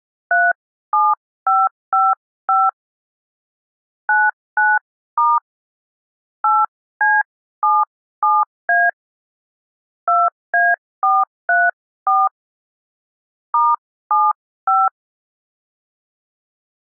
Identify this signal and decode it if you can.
DTMF, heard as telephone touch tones, dialled by hand, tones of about 210 ms. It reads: 37555 99* 8C77A 2A434 *75